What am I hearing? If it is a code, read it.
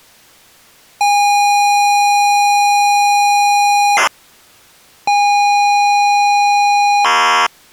ZX Spectrum tape loading, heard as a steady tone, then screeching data.